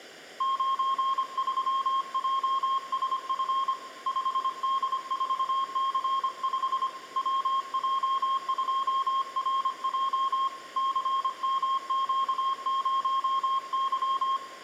Morse code, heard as a keyed tone, hand-sent with a paddle, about 25 wpm, 1070 Hz, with room echo. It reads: 93JSF 5D4C5 WJ2RJ CMQ0Y